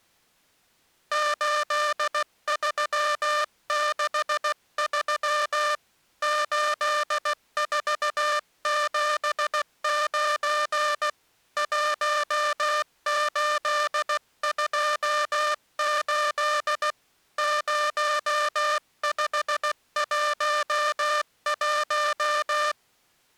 Morse code, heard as a buzzer, hand-sent with a paddle, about 16 wpm. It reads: 8363 8479 1828 0511